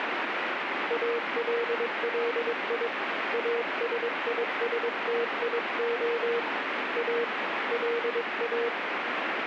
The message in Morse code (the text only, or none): ALLI ASISTIO A LA